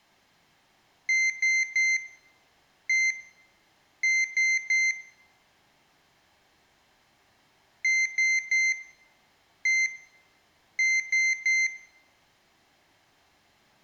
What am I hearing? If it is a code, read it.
Beep code, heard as a piezo beeper, played twice, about 2100 Hz, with room echo. 3-1-3. In Phoenix BIOS tables: interrupt mask register failure.